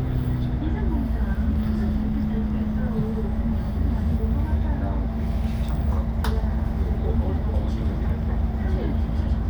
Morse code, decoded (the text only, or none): none